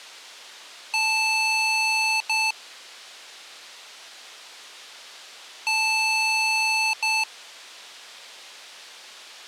Beep code, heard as beeps from a small speaker, played twice, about 880 Hz. 1 long, 1 short. In IBM BIOS tables: system board problem.